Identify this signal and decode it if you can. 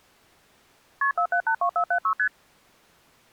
Multi-frequency trunk signalling (R1, as on North American trunks), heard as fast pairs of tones, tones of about 80 ms. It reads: KP 4782476 ST